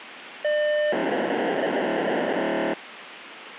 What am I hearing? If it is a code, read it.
POCSAG pager data (1200 baud), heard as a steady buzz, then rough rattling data, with radio hiss.